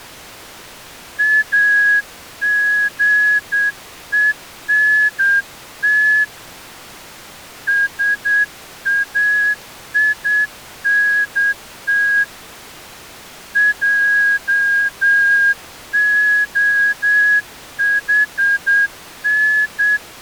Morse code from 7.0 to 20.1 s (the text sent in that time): SAINT JOHN